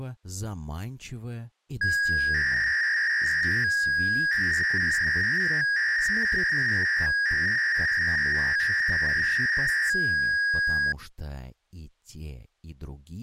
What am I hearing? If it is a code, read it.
300-baud modem data (V.21 tones), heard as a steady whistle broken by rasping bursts, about 300 baud, 200 Hz shift.